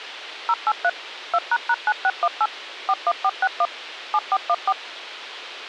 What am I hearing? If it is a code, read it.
DTMF, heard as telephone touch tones, dialled by machine, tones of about 50 ms, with radio hiss. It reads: 083 2##9618 41461 7414